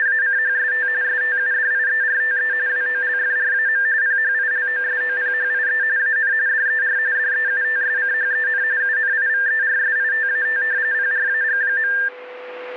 RTTY (45.45 baud, 170 Hz shift), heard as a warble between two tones, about 1700 Hz centre, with radio static and a steady whistle near 500 Hz. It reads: … STUDIERTE WOLFRAM PHILOSOPHIE AN DER DEUTSCHEN UNIVERSITAT PRAG.